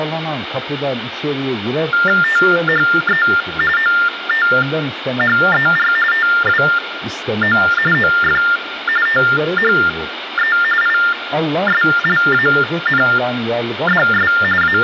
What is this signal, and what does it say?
TTY/TDD text telephone tones (45.45 baud Baudot), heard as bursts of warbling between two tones, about 400 Hz shift, 1600 Hz centre, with phone line noise and room echo. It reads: THE OTHER TWO OF THE ISLANDS …